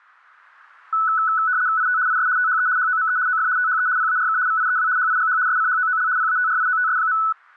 RTTY (75 baud, 170 Hz shift), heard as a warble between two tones, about 1390 Hz centre. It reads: IT IS THE HOME OF THE PARK VIEW HIGH SCHOOL PATRIOTS.